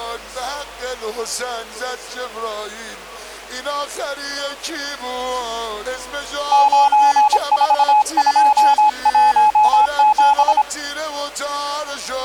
Morse code, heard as a keyed tone, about 26 wpm, 850 Hz. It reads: 94217